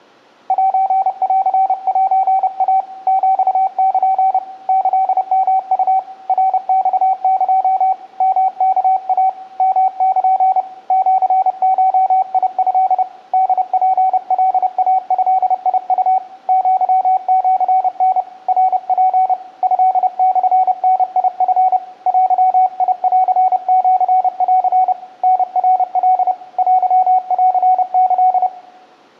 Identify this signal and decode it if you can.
Morse code (Japanese Wabun code), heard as a keyed tone, hand-sent with a paddle, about 30 wpm, 760 Hz, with room echo. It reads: センセイ ヒル キヨウ ナマエ ヨワイ ヨル シゴト ホツカイドウ アシタ ナツ トモダチ デンシン タナカ テンキ